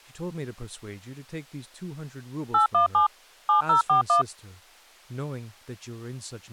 DTMF, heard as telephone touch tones, dialled by machine, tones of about 120 ms, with speech in English. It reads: 817 7041